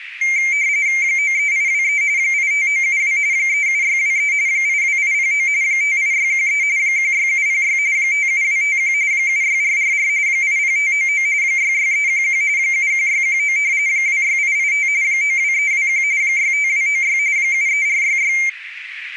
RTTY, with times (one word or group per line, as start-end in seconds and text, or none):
1.0-2.0 93823
2.2-3.2 85972
3.3-4.3 37623
4.5-5.5 82809
5.6-6.6 58613
6.8-7.8 16706
8.0-8.9 57251
9.1-10.1 76444
10.3-11.3 80599
11.4-12.4 66311
12.6-13.6 71619
13.9-14.9 26885
15.0-16.0 92321
16.2-17.2 65296
17.4-18.3 73466